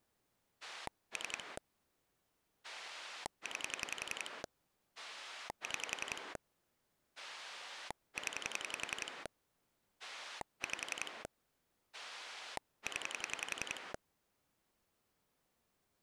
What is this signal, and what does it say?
Pulse dialling, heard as a rotary dial, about 11 pulses a second. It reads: 3 9 6 0 5 0